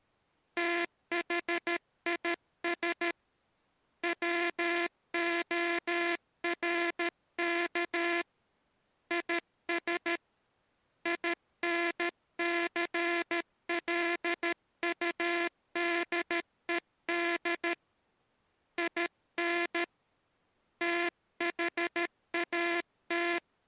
Morse code, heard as a buzzer, hand-sent with a paddle, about 13 wpm. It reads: THIS WORK IS INCLUDED IN THAT